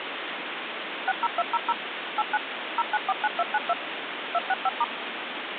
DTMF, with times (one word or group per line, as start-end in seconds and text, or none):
1.1-1.7 60200
2.2-2.4 89
2.8-3.7 0949292
4.3-4.8 265*